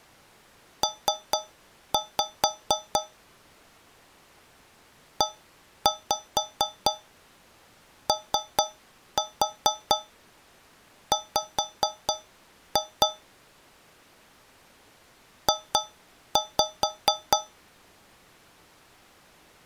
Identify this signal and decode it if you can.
Tap code, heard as taps on a metal pipe, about 4 knocks a second. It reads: P EOW J